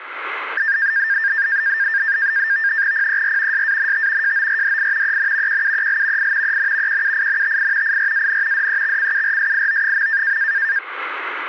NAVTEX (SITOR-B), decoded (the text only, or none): PER SANT JORDI EN QUEL I EN QUINTI IRAN DEXCURSIO.